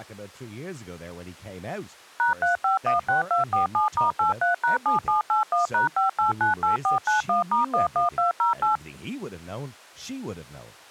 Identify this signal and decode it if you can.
DTMF, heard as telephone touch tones, dialled by machine, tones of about 130 ms, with speech in English. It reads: #3516247*83#7781#5898491*11208